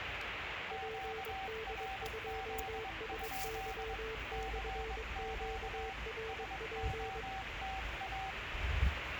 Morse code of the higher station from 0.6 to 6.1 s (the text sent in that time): QRZ? CQ